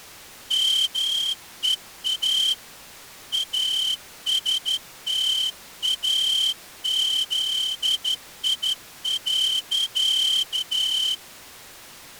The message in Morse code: MEA ASTAZI.

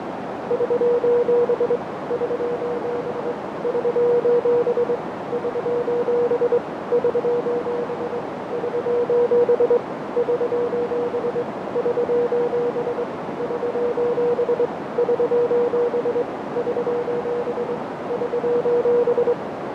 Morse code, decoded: <SOS> <SOS> <SOS> <SOS> <SOS> <SOS> <SOS> <SOS> <SOS> <SOS> <SOS> <SOS>

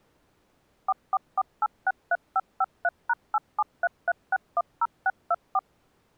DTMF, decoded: 444863553#8733610624

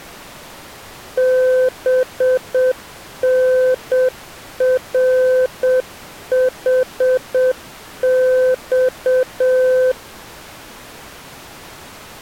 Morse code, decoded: BNRHX

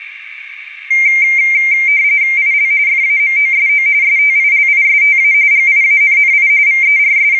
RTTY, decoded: IL FAMOSO STILISTA GIANNI …

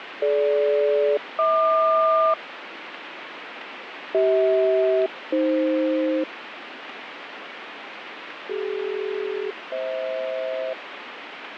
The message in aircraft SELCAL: DG-HQ CH-AF CD-FH

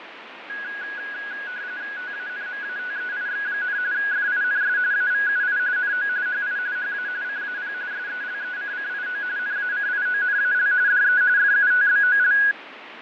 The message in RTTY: TANMATEIX, FINS AVUI NO HI HA CAP SELECCIO NACIONAL DE FUTBOL

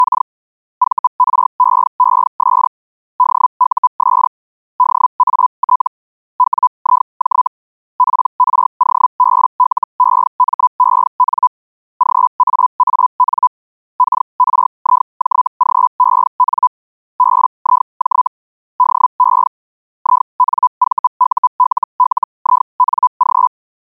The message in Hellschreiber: … VREES DUS DAT WIJ PROBLEMEN GAAN KRIJGEN BIJ DE INVULLING

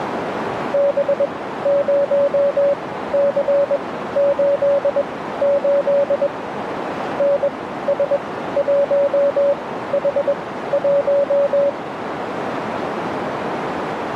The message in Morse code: B0C88 NS1H1

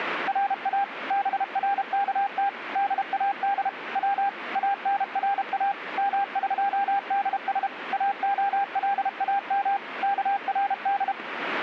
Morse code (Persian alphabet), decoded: را برکت داد و انرا مقدس اعلام کرد

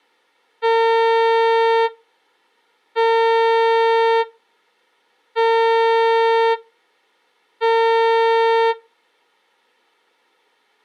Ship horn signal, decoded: 4 short

